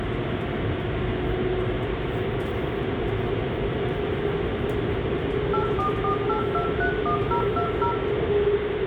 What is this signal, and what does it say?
DTMF, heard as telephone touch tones, dialled by machine, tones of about 100 ms, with phone line noise, room echo and the noise inside a subway train. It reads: 8448231020